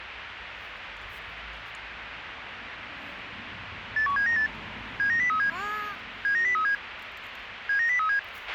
Five-tone selective call (CCIR), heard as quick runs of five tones, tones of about 100 ms, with radio hiss, a squelch burst at the end and street noise. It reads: 81798 79037 79037 79037